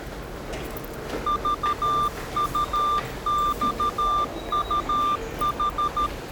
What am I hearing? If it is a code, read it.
Morse code, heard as a keyed tone, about 13 wpm, 1190 Hz, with the noise of a subway station. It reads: VUXUH